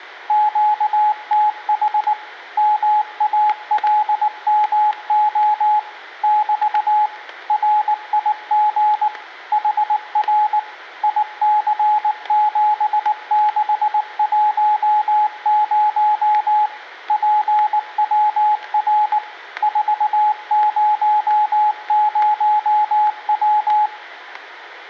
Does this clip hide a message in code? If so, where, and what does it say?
Yes: Morse code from 0.2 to 23.9 s, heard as a keyed tone, machine-sent, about 19 wpm, 850 Hz, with static crashes and room echo. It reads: QTH MALMO <BT> RIG HR IC7610 PWR 400W